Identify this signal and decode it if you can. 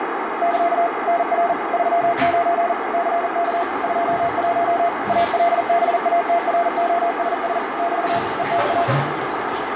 Morse code, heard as a keyed tone, machine-sent, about 40 wpm, 690 Hz, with heavy radio static, a narrow filter and the noise of a restroom. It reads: <KA> NR 39 CK 21 ALBATROSS <BT> ETA